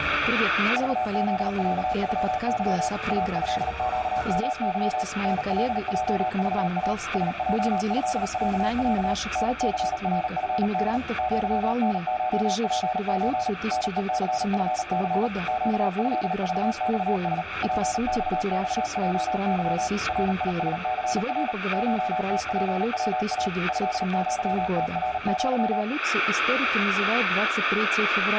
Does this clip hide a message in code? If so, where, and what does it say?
Yes: Morse code (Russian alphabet) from 0.7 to 25.9 s, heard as a keyed tone, machine-sent, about 38 wpm, 740 Hz, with radio static and room echo. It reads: ЖЗЯЮЫ АЭЩМЫ НЛЙЖА СЙЭЯЯ НЦРФД ЪНШПЧ НЕЦФЦ ЩЭЖЬС ПЬЬЙЫ РИСЦР ШТПВА ЭЪТРЪ